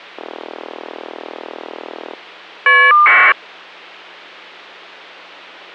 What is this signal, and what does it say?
Caller ID data burst, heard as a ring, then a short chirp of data, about 1200 baud.